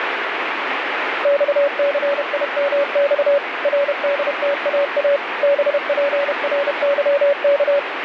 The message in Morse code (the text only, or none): XCIMX RDTAA BPRYK